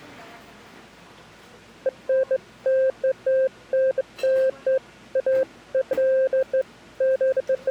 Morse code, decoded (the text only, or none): none